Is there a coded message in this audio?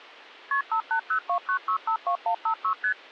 Yes: multi-frequency trunk signalling (R1, as on North American trunks) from 0.5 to 2.9 s, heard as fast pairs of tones, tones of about 90 ms. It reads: KP 58029652156 ST